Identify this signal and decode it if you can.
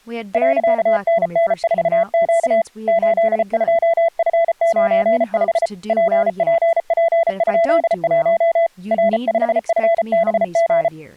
Morse code, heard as a keyed tone, hand-sent with a paddle, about 34 wpm, 670 Hz, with speech in English. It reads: .NN4Q 82F95 PPP?1 R5FBG